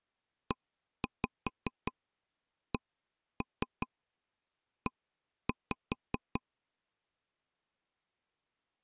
Tap code, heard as taps on a table, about 5 knocks a second. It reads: ECE